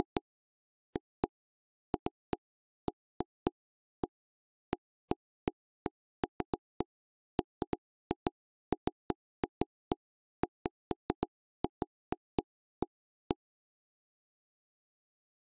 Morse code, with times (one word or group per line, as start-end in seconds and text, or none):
none